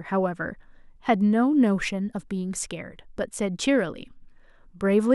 Speech in English. There is no code.